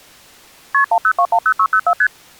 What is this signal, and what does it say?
Multi-frequency trunk signalling (R1, as on North American trunks), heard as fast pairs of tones, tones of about 70 ms. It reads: KP 10210604 ST